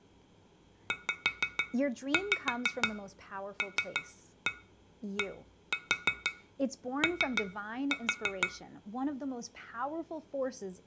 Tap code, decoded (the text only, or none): ZLDO